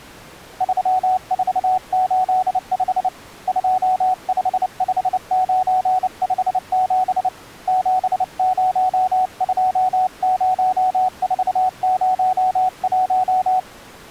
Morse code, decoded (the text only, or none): 3485 255957 7020401